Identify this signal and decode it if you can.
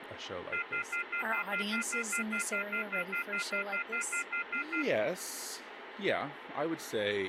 Telephone call progress tone (North American plan), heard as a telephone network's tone, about 1400, 2050, 2450, 2600 Hz, 0.1 s on and 0.1 s off, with phone line noise and speech in English. Off-hook warning tone.